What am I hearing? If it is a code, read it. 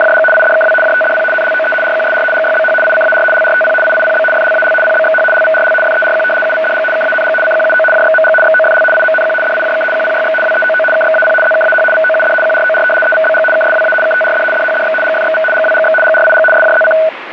RTTY (75 baud, 850 Hz shift), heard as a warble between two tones, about 1060 Hz centre, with radio static. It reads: … IDKW JTDP NLOE RQSR GYBH ICAR LRTP IIPB FLAL PBXH LVRL FERQ UVDG KANG CQUO JXMG XOFL IMNQ DIJK QPYX WEOO KXAP ZKAH VOUD QROR EVBG KSWA KTRD DHDX GFXV GWGX GRIG SJZC